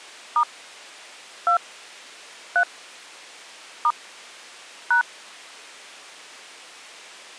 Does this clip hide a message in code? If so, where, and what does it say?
Yes: DTMF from 0.4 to 5.0 s, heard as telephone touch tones, dialled by hand, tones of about 80 ms. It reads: * 2 3 * #